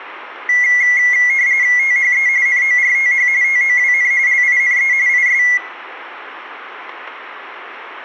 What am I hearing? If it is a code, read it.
RTTY (45.45 baud, 170 Hz shift), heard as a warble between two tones, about 2050 Hz centre, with room echo. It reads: THE NORTH TOWN LINE IS